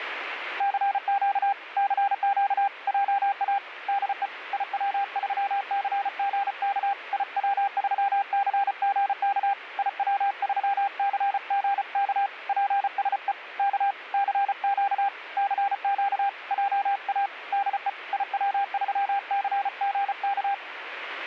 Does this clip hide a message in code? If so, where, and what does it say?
Yes: Morse code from 0.5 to 20.6 s, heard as a keyed tone, hand-sent with a paddle, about 34 wpm, 800 Hz, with radio static. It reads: CQ CQ JA DE IW3CGK IW3CGK IW3CGK PSE K CQ CQ JA DE IW3CGK